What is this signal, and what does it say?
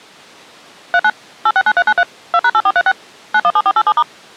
DTMF, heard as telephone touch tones, dialled by machine, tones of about 60 ms. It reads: 39 869393 2#8436 917487*